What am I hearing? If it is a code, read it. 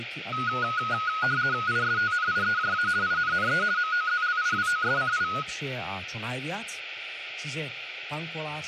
RTTY (50 baud, 170 Hz shift), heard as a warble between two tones, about 1360 Hz centre, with radio static and speech in Czech. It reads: ISTNIEJA INNE MOZLIWOSCI